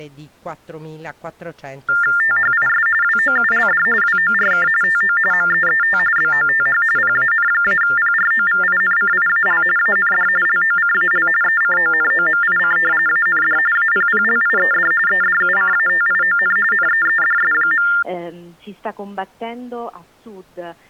TTY/TDD text telephone tones (45.45 baud Baudot), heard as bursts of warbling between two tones, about 400 Hz shift, 1600 Hz centre. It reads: THIS WOULD WORK TO MEET BOTH PAN-PROVINCIAL AND LOCAL ECONOMIC AND APPLIED EDUCATION NEEDS.